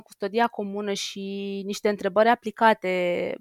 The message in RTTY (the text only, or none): none